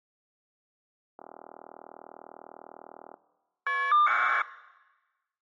Caller ID data burst, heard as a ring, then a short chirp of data, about 1200 baud.